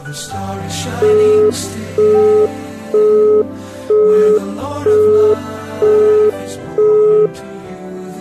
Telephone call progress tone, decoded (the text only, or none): busy tone